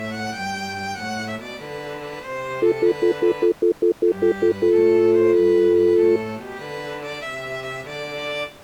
Telephone call progress tone (North American plan), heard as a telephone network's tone, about 350, 440 Hz, 0.1 s on and 0.1 s off. Stutter dial tone.